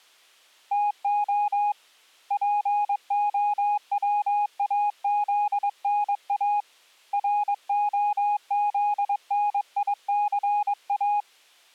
Morse code, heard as a keyed tone, hand-sent with a paddle, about 22 wpm, 830 Hz. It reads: TO POWAZNA ROZNICA